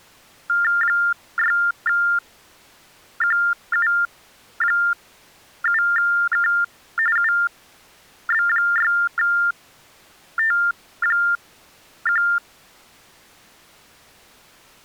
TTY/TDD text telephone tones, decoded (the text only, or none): 6QU7K UB6T1